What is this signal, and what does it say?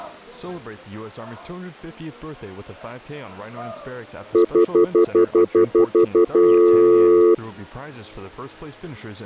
Telephone call progress tone (North American plan), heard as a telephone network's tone, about 350, 440 Hz, 0.1 s on and 0.1 s off. Stutter dial tone.